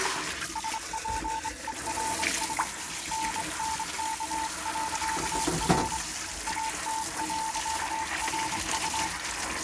Morse code, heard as a keyed tone, hand-sent with a straight key, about 25 wpm, 890 Hz, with kitchen noise. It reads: SPERS NNK.R AT.RU